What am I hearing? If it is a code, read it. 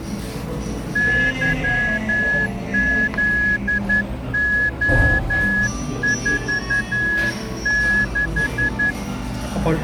Morse code, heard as a whistle, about 11 wpm, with the noise of a cafe. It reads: YZO46